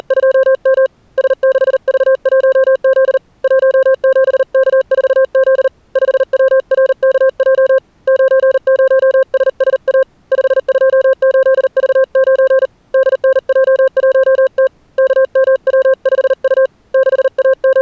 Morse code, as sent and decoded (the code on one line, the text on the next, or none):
… / ... -.... ...- .---- --.. / .---- --... -.- ....- --.. / ..... .-- .-. -.- .--- / ----. ----- ... ... .- / ..... ..--- ---.. ...- ----. / -.. -. .--- .---- - / -.- -- .-- ..... ..- / …
… S6V1Z 17K4Z 5WRKJ 90SSA 528V9 DNJ1T KMW5U …